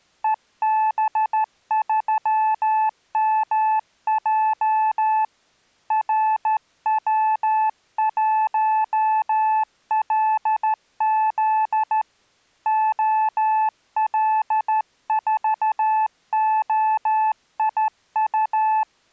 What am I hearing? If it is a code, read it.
Morse code, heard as a keyed tone, hand-sent with a straight key, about 13 wpm, 870 Hz. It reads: EB3MJ RW1LZ OL4OIU